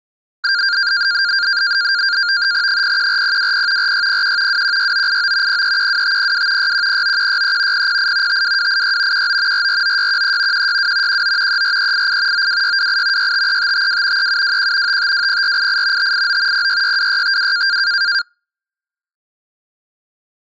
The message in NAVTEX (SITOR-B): 014020 4601 216989 0312502 6109163 008 52286 19 449613 162 19 34388 92628 653552 3721 5520488 589 0662652

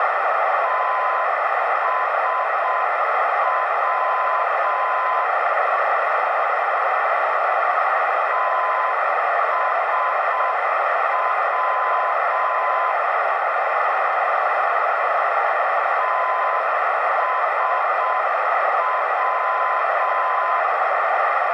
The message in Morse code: TSW TSW TSW

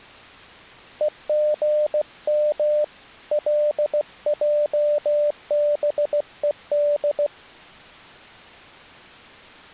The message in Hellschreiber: none

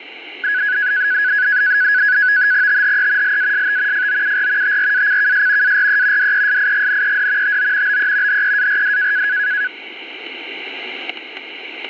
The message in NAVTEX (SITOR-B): THE LAST FOUR TRACKS ARE DESIGNED TO BE HEARD

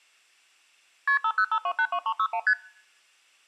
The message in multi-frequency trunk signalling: KP 505282361 ST

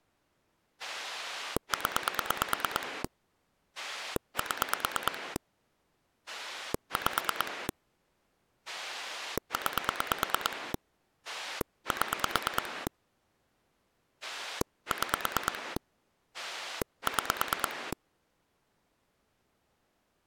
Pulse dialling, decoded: 0 7 5 9 7 6 6

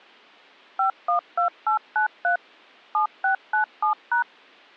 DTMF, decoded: 512893 7697#

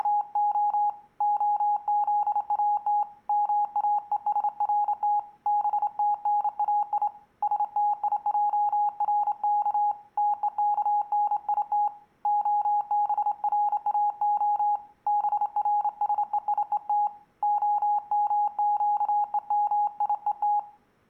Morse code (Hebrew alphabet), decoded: … הזאת מאושרת בתנאי שתיערך תוכנית הבראה ברשויות המקומיות

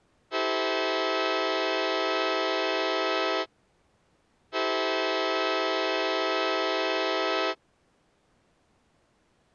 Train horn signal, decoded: 2 long

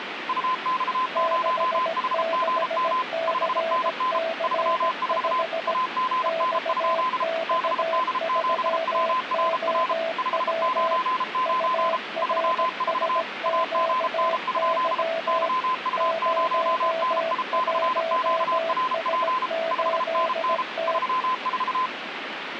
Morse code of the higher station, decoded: UX0HGM 5NN 34 AGN? BD7WRR 599 34 AGN? YU0NI/QRP 5NN 34

